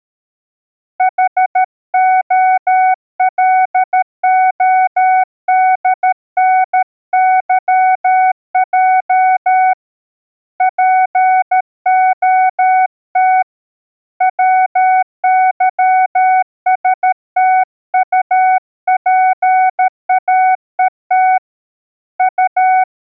Morse code (Russian alphabet), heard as a keyed tone, hand-sent with a paddle, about 13 wpm, 750 Hz. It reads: ХОЛОДНЫЙ ПОТ ВЫСТУПАЕТ У